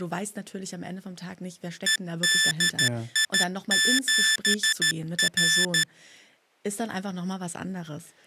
Morse code, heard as electronic beeps, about 13 wpm, 1750 Hz, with speech in German. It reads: EDI7R